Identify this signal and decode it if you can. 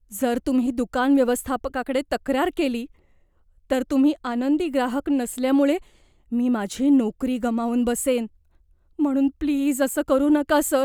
Speech in Marathi. There is no code.